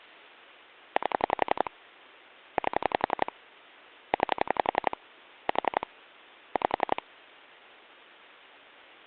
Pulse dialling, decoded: 8 8 9 4 5

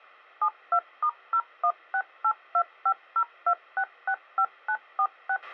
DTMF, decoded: 72*01682502665946

